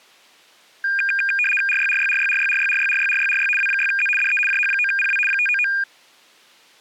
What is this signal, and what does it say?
RTTY (75 baud, 850 Hz shift), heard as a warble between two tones, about 2000 Hz centre. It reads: RYRYRYRYRYRYRYRYRY W6Z DE JH9PW 599